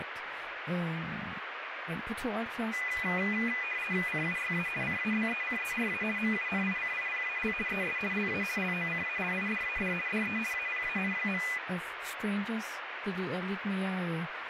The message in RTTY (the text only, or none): CUYA CABECERA MUNICIPAL ES LA LOCALIDAD DE APAN.